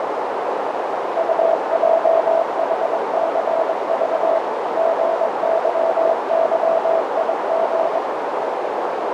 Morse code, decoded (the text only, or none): UJHCV GYYIG